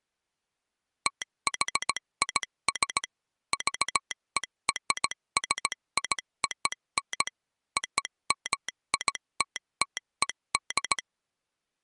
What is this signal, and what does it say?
Morse code (American railroad code), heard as a telegraph sounder, machine-sent. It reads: THIS VERSION OMITTED